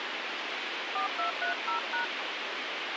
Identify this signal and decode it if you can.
DTMF, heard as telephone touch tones, dialled by hand, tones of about 120 ms, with radio hiss. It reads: 4230#